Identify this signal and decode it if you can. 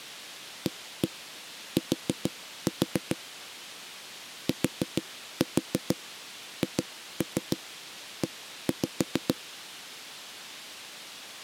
Tap code, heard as knocks on a wall, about 6 knocks a second. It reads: AT THE